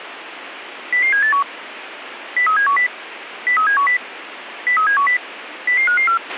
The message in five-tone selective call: 00781 03710 03710 03710 00554

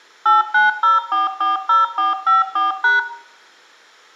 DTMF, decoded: 890440454#

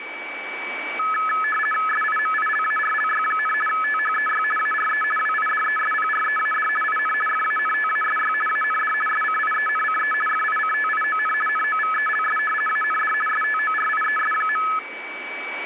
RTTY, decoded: SIMILARLY, THEY ARE WIDESPREAD IN FANTASY AND SCIENCE FICTION NOVELS AND STORIES.

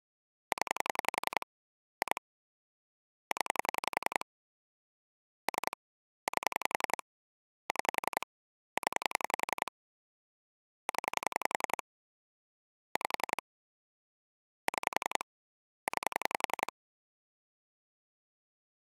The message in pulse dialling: 0 2 0 3 8 6 0 0 5 6 9

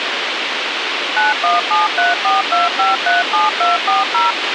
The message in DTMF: 917342537240

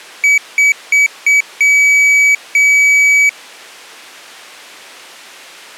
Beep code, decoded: 4 short, 2 long

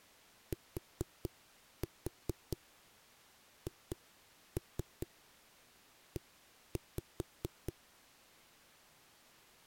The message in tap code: THE

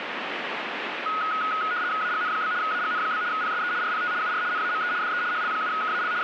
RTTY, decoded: AGN? AGN? PSE RPT UR NAME DE HL7KAL …

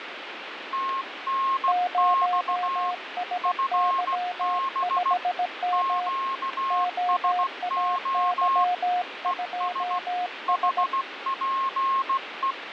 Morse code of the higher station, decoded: TNX FB QSO ES HPE

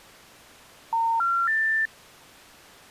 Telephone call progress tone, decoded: special information tone

